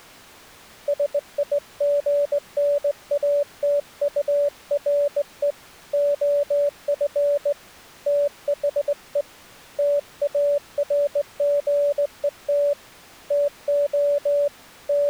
Morse code, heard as a keyed tone, hand-sent with a straight key, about 18 wpm, 580 Hz. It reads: SIGNATURE OF THE TARGET TO …